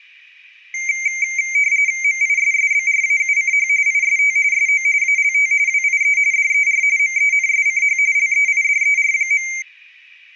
RTTY (45.45 baud, 170 Hz shift), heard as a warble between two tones, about 2200 Hz centre. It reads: MISSBRAUCH IST SO ALT WIE DER MENSCH LEIDER.